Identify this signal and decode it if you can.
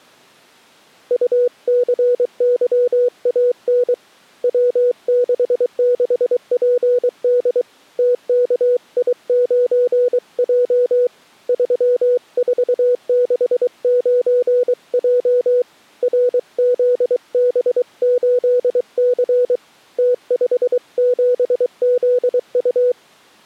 Morse code, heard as a keyed tone, hand-sent with a paddle, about 23 wpm, 490 Hz. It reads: UCYAN W66PD TKI9J 3469J RZB8C T57ZU